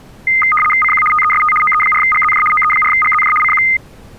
RTTY (75 baud, 850 Hz shift), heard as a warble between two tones, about 1650 Hz centre. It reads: CQ TEST OE4GZJ OE4GZJ CQ